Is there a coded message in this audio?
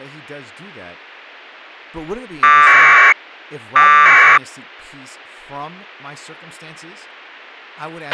Yes: packet radio (AX.25, as in APRS), 1200 baud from 2.4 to 4.4 s, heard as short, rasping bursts, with a squelch burst at the end and speech in English.